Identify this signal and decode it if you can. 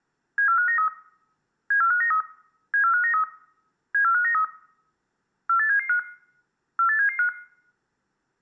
Five-tone selective call (CCIR), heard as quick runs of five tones, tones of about 100 ms. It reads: 74593 74593 74593 74593 48775 48775